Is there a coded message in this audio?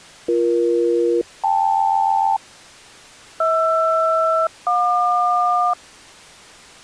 Yes: aircraft SELCAL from 0.3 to 5.7 s, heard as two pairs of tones. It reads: BE-KL HR-JQ